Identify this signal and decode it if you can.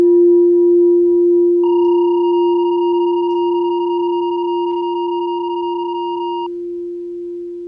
PSK31 (31.25 baud), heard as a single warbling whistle, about 940 Hz.